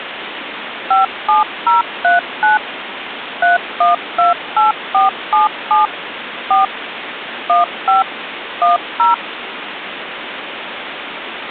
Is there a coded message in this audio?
Yes: DTMF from 0.9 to 9.1 s, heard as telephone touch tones, dialled by machine, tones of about 150 ms, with phone line noise. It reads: 57039 3128477 4 15 10